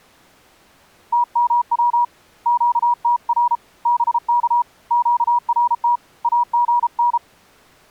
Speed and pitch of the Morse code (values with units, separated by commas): 33 wpm, 960 Hz